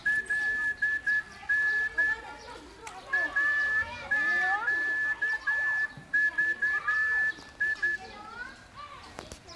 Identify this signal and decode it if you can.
Morse code (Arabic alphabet), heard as a whistle, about 10 wpm, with room echo and the noise of a park. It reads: لن اقضي